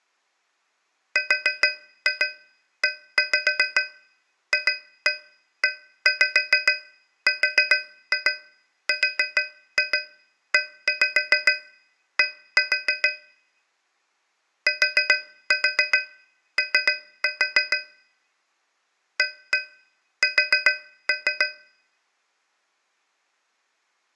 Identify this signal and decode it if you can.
Tap code, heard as taps on a metal pipe, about 7 knocks a second. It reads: REFERRED TO AS